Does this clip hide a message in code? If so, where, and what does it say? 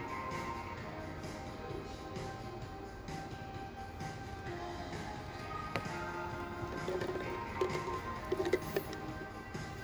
No, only the noise of a cafe.